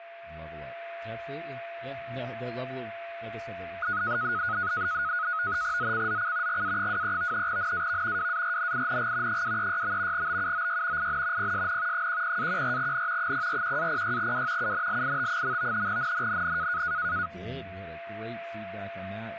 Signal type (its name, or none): NAVTEX (SITOR-B)